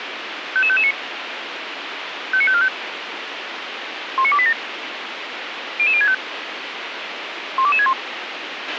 Five-tone selective call (ZVEI), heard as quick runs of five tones, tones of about 70 ms, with radio hiss and a squelch burst at the end. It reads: 55559 59545 19287 00065 12261